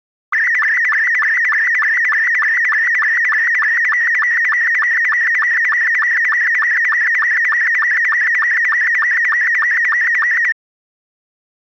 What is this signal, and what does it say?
SSTV (slow-scan television), Robot 72, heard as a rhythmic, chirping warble.